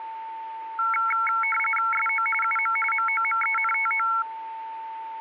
RTTY (45.45 baud, 850 Hz shift), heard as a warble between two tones, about 1800 Hz centre, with a steady whistle near 900 Hz. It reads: SO UM MOMENTO